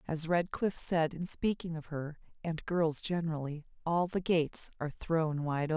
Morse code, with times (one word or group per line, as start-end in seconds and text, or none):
none